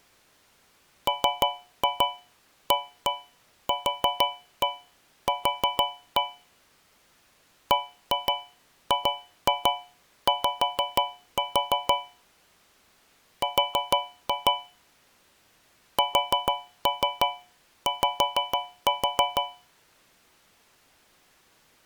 Tap code, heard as taps on a metal pipe, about 6 knocks a second. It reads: MAQQ BGY R SY